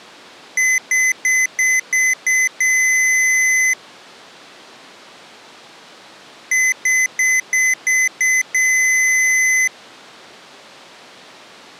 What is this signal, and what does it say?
Beep code, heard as beeps from a small speaker, played twice, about 2050 Hz. 6 short, 1 long.